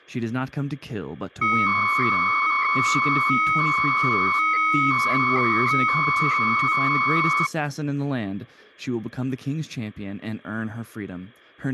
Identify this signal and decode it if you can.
300-baud modem data (Bell 103 tones), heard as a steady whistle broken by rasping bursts, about 300 baud, 200 Hz shift, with speech in English.